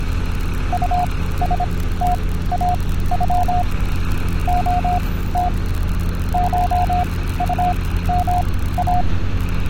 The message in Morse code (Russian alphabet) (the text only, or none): УСТАЮ ОТ ШУМА